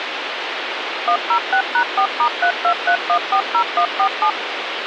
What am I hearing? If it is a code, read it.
DTMF, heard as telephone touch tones, dialled by machine, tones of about 80 ms, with phone line noise. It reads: 106#4*323140147